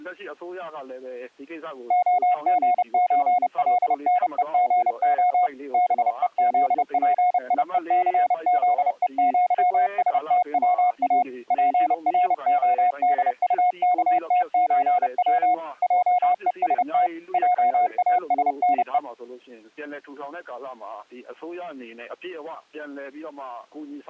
Morse code (with Polish letters), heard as a keyed tone, machine-sent, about 30 wpm, 720 Hz. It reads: OGÓLNEGO BEZPIECZEŃSTWA PRODUKTÓW JEST JASNE